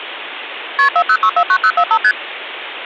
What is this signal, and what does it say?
Multi-frequency trunk signalling (R1, as on North American trunks), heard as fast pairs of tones, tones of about 70 ms, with phone line noise. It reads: KP 40649045 ST